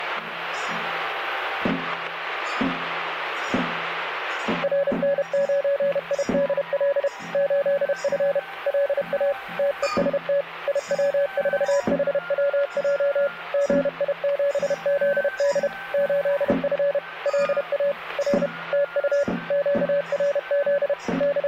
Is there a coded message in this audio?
Yes: Morse code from 4.6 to 21.5 s, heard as a keyed tone, machine-sent, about 31 wpm, 570 Hz. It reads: RN9IDL 8F LA TEST IW4HWJ GI7ZD 8F LA R TU QRZ …